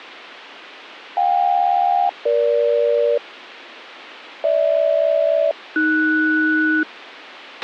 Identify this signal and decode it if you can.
Aircraft SELCAL, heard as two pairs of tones, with a squelch burst at the end. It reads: JK-EG GH-AS